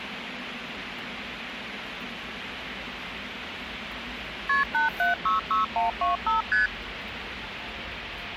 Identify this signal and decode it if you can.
Multi-frequency trunk signalling (R1, as on North American trunks), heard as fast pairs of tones, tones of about 140 ms, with phone line noise and the noise of a subway station. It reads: KP 8766125 ST